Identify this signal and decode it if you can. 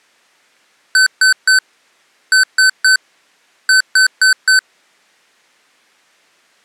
Beep code, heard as beeps from a small speaker, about 1500 Hz. 3-3-4. In Phoenix BIOS tables: video failure.